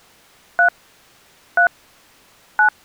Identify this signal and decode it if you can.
DTMF, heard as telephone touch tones, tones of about 100 ms. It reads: 3 3 9